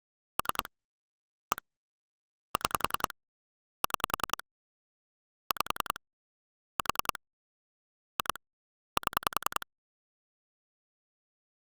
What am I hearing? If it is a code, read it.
Pulse dialling, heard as clicks on a phone line, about 10 pulses a second. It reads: 3 1 6 6 5 4 2 7